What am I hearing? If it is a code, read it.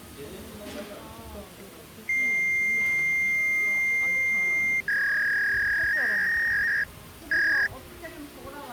Fax machine handshake, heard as a long tone and a warble, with the noise of a restaurant.